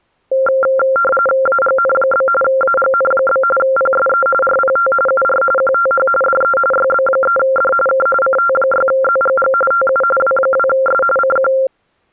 RTTY (45.45 baud, 850 Hz shift), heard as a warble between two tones, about 960 Hz centre. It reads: AGN? AGN? PSE RPT UR QTH DE YB3D K CT6ZGG TU W2S CQ